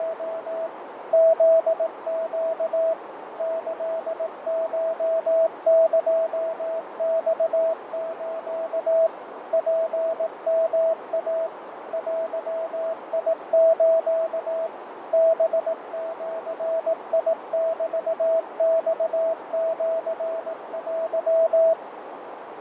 Morse code (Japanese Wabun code), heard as a keyed tone, machine-sent, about 18 wpm, 650 Hz, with radio static, fading and a narrow filter. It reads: … フネ キコエマス ツヨイ デス ハジメマシテ